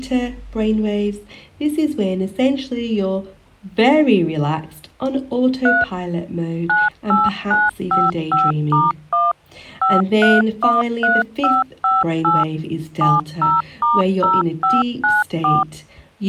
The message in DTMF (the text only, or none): 3 98955*1 5313558 70*0594